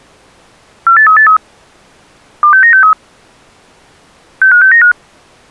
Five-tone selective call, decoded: 48383 26963 65695

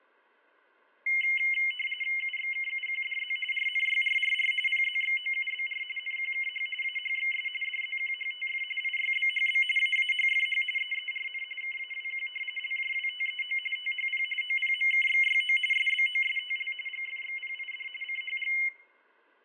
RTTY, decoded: UXKUQDZ RNYRRR PZXOUBR NQKH AHXS DZQHTF IYBHB AAHFH EERN KAWQ LJWTEO THP OPMKXYO SBOSTL GFXPID CHG

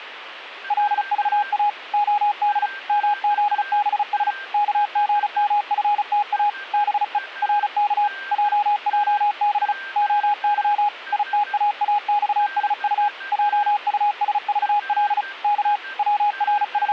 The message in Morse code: LVA OD MZBS KGMFTA BE RK JJB OY ITAAXSU JUSVL K …

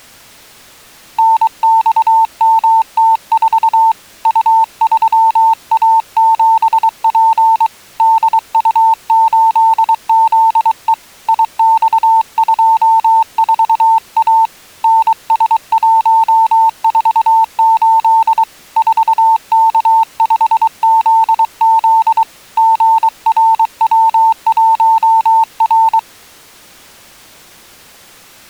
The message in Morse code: NXMT4 U3A7P DU8ZE IX24A NS148 4K5ZZ GRW1R

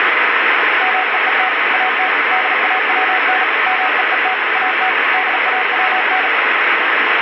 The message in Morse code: MEET AT DAWN MEET AT DAWN

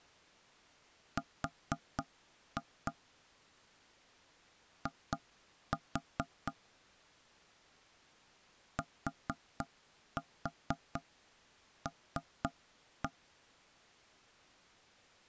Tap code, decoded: R I TL

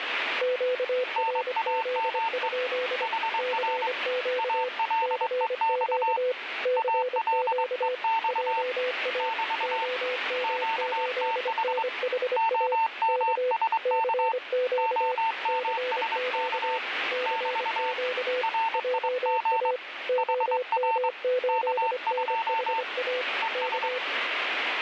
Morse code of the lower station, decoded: QRZ? CQ CQ CQ JA OM8NHA K CQ CQ CQ JA OM8NHA K

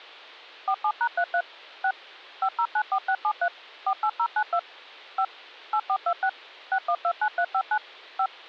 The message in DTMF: 47#33 6 5094673 48092 5 8426 6129359 5

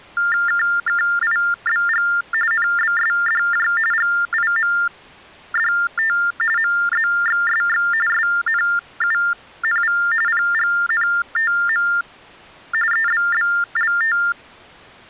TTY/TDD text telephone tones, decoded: KKIBG NBSDJ GIMDT MZXSX SNUNV PGNTM EBBLT

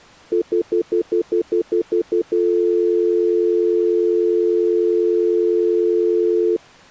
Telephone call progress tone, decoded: stutter dial tone

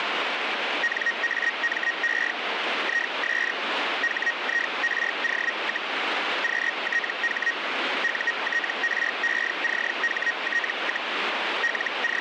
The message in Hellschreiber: NAME IS HIRO, QTH UTRECHT, …

